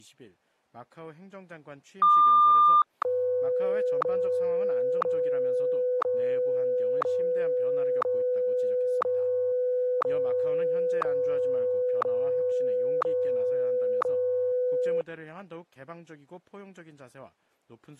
Radio time signal (WWVH, Hawaii), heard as ticks, one a second.